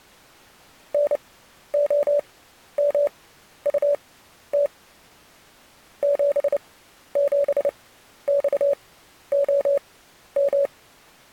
Morse code, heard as a keyed tone, machine-sent, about 29 wpm, spaced as for 12 wpm, 570 Hz. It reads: NOMUT 77XOM